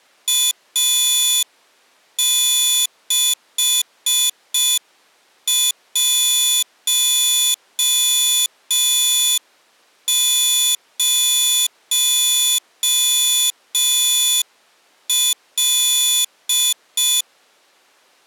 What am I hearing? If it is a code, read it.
Morse code, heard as a high beeper, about 5 wpm, 3450 Hz. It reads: A610L